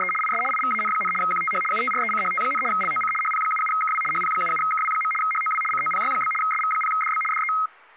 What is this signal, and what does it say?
RTTY (75 baud, 850 Hz shift), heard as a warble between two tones, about 1700 Hz centre, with speech in English. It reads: … IS IVAN, QTH UTRECHT, LOC HP77KW HP77KW. HOW COPY? SV0DB DE